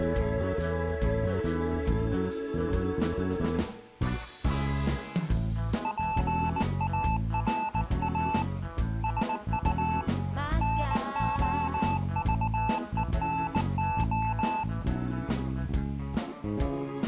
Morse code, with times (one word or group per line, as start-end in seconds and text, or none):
5.8-8.4 PARA
9.0-10.0 SU
10.6-14.6 NOVENO